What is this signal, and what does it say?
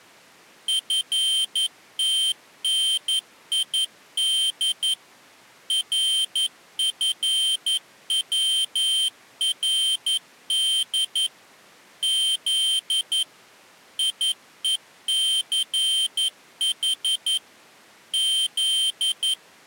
Morse code, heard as a high beeper, machine-sent, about 11 wpm, 3150 Hz. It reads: FTNID RFWRD Z IECH Z